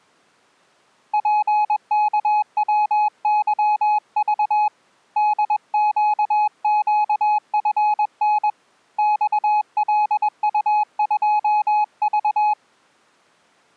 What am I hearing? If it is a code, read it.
Morse code, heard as a keyed tone, hand-sent with a paddle, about 21 wpm, 840 Hz. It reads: PKWYV DQQFN XLU2V